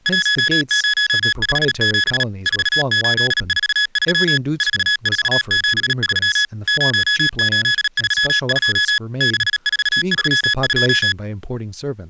Morse code, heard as electronic beeps, machine-sent, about 37 wpm, 1700 Hz, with speech in English. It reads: 1057 4843 4473 0832 6432